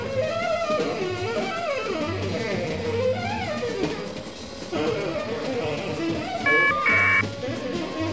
Caller ID data burst, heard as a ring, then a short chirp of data, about 1200 baud.